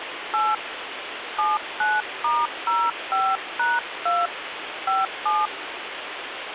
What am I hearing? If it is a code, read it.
DTMF, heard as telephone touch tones, dialled by hand, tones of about 210 ms, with phone line noise. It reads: 8 79*05#2 57